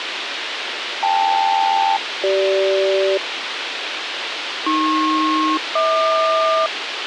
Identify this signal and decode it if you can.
Aircraft SELCAL, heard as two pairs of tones, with radio hiss. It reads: KL-CG AP-HQ